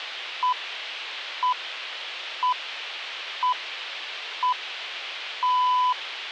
Radio time signal (six pips, as the Greenwich Time Signal), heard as pips.